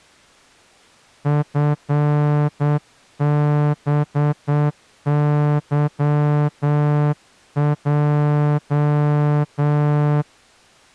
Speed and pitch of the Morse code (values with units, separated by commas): 8 wpm